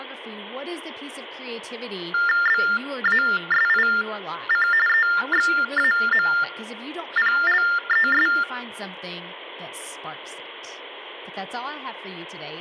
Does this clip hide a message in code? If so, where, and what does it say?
Yes: TTY/TDD text telephone tones (45.45 baud Baudot) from 2.1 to 8.4 s, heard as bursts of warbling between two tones, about 400 Hz shift, 1600 Hz centre, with speech in English. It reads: BASIC EXAMPLES